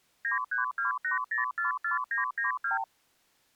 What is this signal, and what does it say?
Multi-frequency trunk signalling (R2, with the far end's replies), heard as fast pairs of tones, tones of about 130 ms. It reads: 9328044992